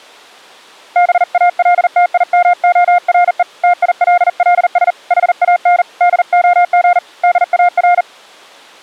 Morse code, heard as a keyed tone, hand-sent with a bug key, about 40 wpm, 710 Hz. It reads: BALTIMORE TILLS HAN DOG DAR